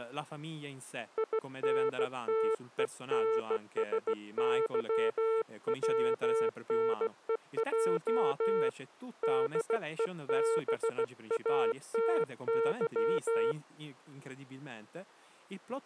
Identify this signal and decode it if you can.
Morse code, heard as a keyed tone, hand-sent with a bug key, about 16 wpm, 450 Hz, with speech in Italian. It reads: INTENSYWNEJ DEBATY